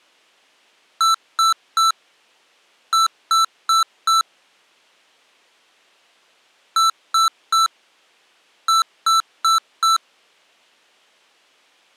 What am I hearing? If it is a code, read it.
Beep code, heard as beeps from a small speaker, played twice, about 1330 Hz. 3-4.